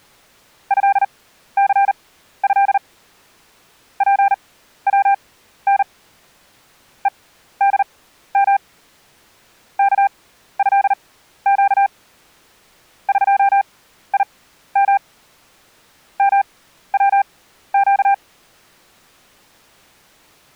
Morse code (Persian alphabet), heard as a keyed tone, machine-sent, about 39 wpm, spaced as for 14 wpm, 790 Hz. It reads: ضثض پون هدم کضگ قیم موگ